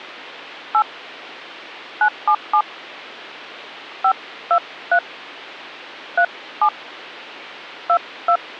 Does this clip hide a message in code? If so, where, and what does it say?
Yes: DTMF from 0.7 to 8.4 s, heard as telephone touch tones, dialled by hand, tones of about 80 ms. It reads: 8 977 523 37 22